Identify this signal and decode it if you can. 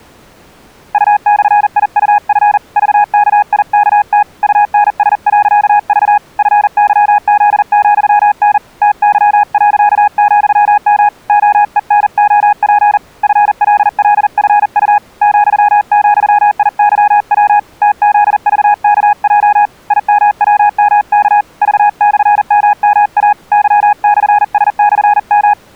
Morse code, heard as a keyed tone, hand-sent with a paddle, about 40 wpm, 830 Hz. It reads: U/IUF VKIKT UNS.V FYZ,N TY.,M OENOP FLLFU ,,IYW TZVKJ IMWMK V/MMA Y/S/M